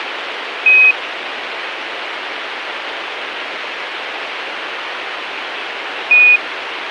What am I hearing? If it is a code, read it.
Quindar tones, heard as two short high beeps, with radio hiss.